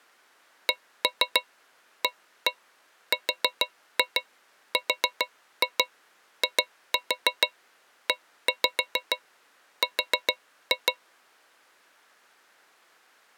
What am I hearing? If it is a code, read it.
Tap code, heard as taps on a metal pipe, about 6 knocks a second. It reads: CARRIER